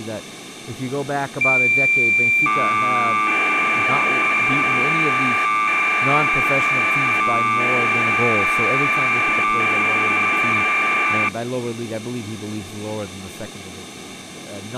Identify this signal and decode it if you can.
Cassette data (Kansas City type), 1200 baud, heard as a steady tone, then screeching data, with speech in English.